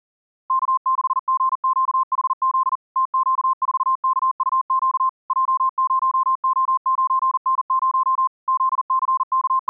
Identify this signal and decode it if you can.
Morse code, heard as a keyed tone, machine-sent, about 40 wpm, 1050 Hz. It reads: K6GQHZ TQ4KUQ J0O9N0 …